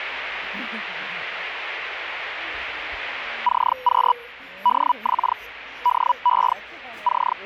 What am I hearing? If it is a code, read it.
Hellschreiber (Feld-Hell, 122.5 baud), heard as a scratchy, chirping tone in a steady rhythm, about 980 Hz, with the noise of a subway station. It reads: CQ DX DE …